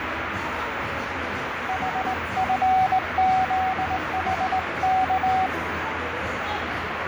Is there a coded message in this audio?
Yes: Morse code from 1.6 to 5.5 s, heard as a keyed tone, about 19 wpm, 750 Hz, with radio static, fading and the noise of a crowd indoors. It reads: HFZHK